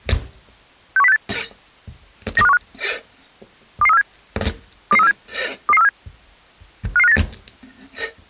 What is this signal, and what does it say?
Five-tone selective call (EEA), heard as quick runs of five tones, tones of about 40 ms, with kitchen noise. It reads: 61068 92515 22347 22347 22347 55598